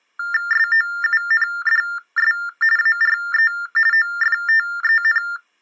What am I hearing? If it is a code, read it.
TTY/TDD text telephone tones (45.45 baud Baudot), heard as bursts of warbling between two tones, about 400 Hz shift, 1600 Hz centre. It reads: SOUNDS ARE OFTEN